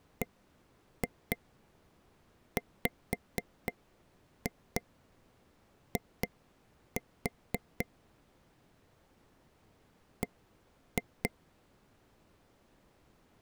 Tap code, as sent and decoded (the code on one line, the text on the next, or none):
1-2 5-2 2-4 / 1-2
BWI B